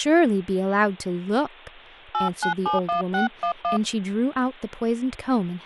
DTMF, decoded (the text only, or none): 8971611